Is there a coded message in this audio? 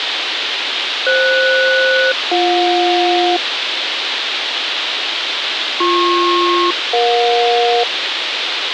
Yes: aircraft SELCAL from 1.1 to 7.8 s, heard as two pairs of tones, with radio hiss. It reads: FS-BJ BP-EJ